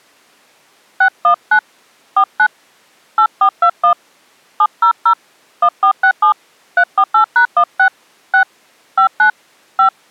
DTMF, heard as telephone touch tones, dialled by hand, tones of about 80 ms. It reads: 619 49 8421 700 1467 348#16 6 59 5